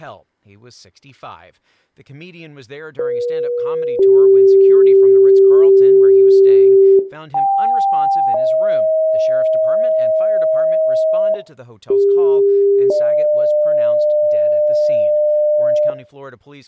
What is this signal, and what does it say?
Two-tone page, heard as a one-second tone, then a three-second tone, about 480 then 390 Hz, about 790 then 630 Hz, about 400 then 600 Hz, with speech in English.